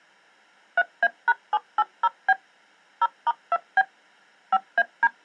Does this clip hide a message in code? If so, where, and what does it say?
Yes: DTMF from 0.8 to 5.1 s, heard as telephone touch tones, dialled by machine, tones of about 40 ms. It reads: 3A#780B 0*2B 5AD